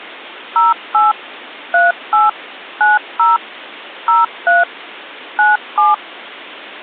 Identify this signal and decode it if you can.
DTMF, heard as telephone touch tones, dialled by machine, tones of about 170 ms. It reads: 08 38 90 03 97